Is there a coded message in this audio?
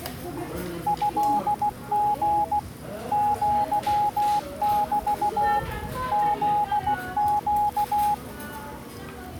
Yes: Morse code (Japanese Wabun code) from 0.8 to 8.2 s, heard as a keyed tone, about 16 wpm, 830 Hz, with the noise of a restaurant. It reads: トリ アメ フネ